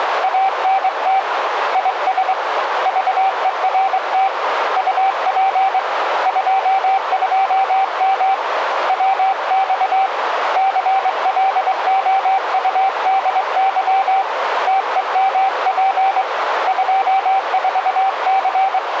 Morse code, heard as a keyed tone, hand-sent with a straight key, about 23 wpm, 780 Hz, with radio static and a narrow filter. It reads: ANT IS VERT UP 22M WX CLOUDY TEMP 24C